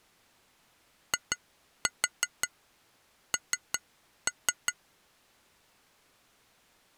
Tap code, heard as taps on glass, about 5 knocks a second. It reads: IN